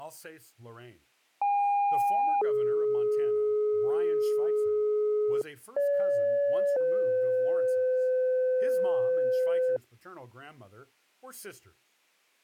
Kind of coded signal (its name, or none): two-tone page